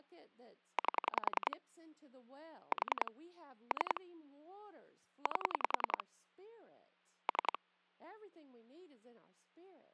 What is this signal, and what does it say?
Pulse dialling, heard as clicks on a phone line, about 10 pulses a second, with speech in English. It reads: 8 4 3 8 3